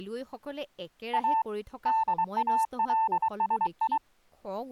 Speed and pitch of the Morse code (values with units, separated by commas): 23 wpm, 890 Hz